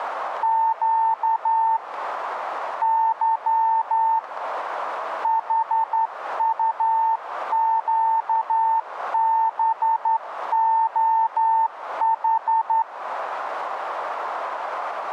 Morse code, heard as a keyed tone, hand-sent with a straight key, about 11 wpm, 900 Hz, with radio static and a narrow filter. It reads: Q Y HUQBOH